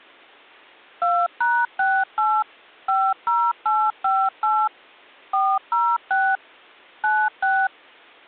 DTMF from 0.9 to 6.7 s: 2#68 50858 406

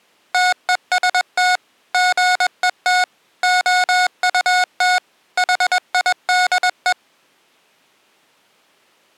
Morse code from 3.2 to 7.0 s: OUT HIDE

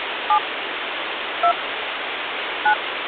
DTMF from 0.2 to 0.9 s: 7

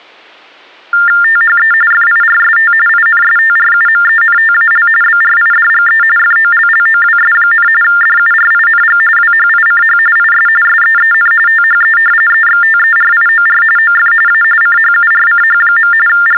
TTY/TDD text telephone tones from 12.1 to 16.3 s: EXTERIOR OF A CHURCH. …

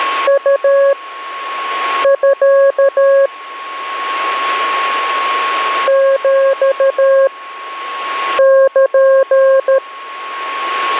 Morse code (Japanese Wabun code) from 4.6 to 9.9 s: ヒル

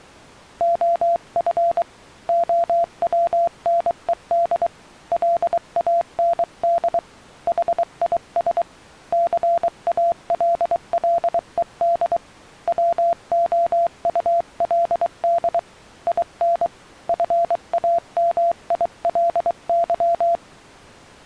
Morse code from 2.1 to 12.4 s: OWNED LAND HIS CALLED

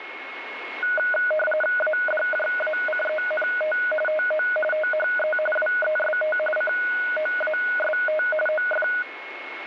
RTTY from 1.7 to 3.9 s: ADJACENT

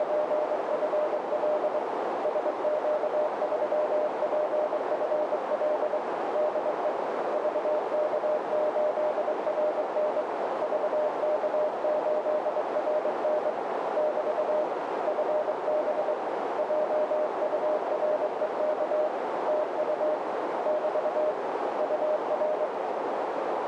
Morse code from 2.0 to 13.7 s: SQ3PFL DE VK8RN VK8RN

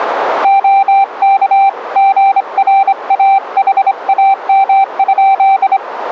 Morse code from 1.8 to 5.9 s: GRAHAM?

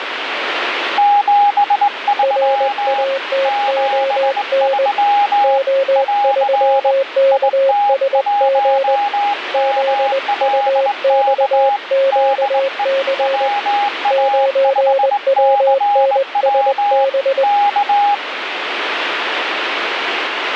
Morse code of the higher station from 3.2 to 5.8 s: 73

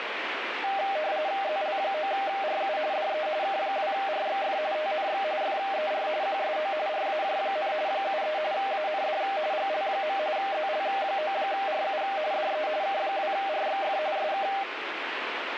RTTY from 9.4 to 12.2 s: GL. ZL9RU

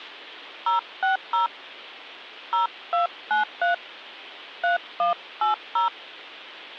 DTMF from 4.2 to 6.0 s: 3180

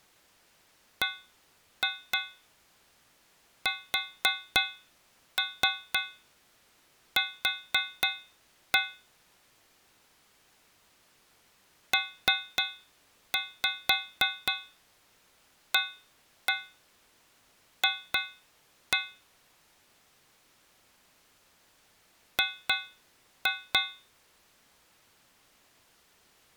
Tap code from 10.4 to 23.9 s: PAF G

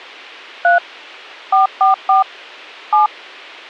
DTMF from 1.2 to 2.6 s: 444

